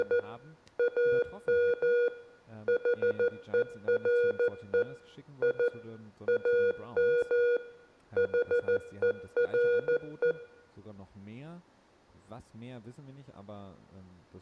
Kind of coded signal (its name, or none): Morse code